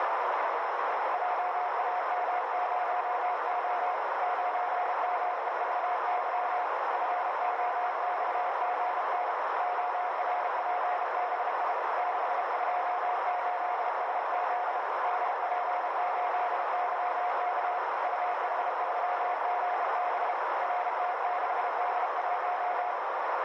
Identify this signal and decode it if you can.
Morse code, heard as a keyed tone, hand-sent with a bug key, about 32 wpm, 720 Hz, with heavy radio static and a narrow filter. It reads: JAM0O 9MEVY FOXGN ORPBI 628SZ DP8YK UH3GB RT6D1